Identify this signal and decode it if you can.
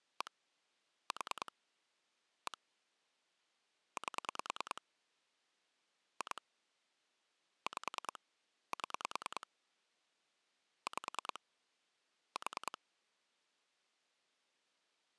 Pulse dialling, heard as clicks on a phone line, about 10 pulses a second. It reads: 1 4 1 8 2 5 7 5 4